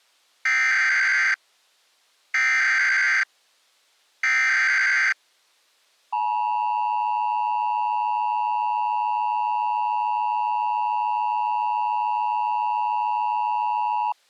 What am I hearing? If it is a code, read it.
Emergency Alert System (SAME) tones (header bursts, then the 853 and 960 Hz attention tone), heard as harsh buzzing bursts, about 520.83 baud.